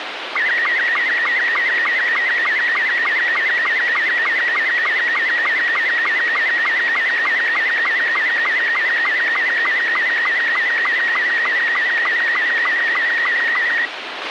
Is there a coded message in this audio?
Yes: SSTV (slow-scan television), Robot 72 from 0.4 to 13.9 s, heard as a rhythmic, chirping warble, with radio hiss and a squelch burst at the end.